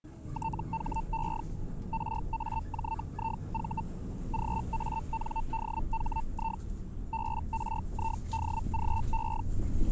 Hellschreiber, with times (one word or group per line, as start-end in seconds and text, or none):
0.3-1.4 THE
1.9-3.8 RAJIV
4.3-6.6 GANDHI
7.1-9.4 BRIDGE